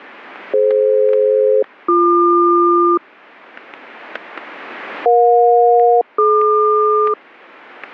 Aircraft SELCAL, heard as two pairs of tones, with static crashes. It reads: DF-BQ EJ-DQ